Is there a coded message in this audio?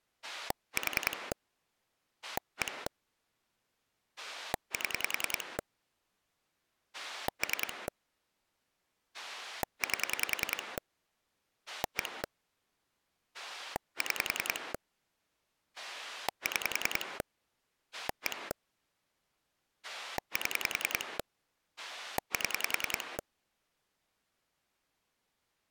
Yes: pulse dialling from 0.2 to 23.2 s, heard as a rotary dial, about 10 pulses a second. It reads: 4 1 7 3 8 1 6 6 1 7 7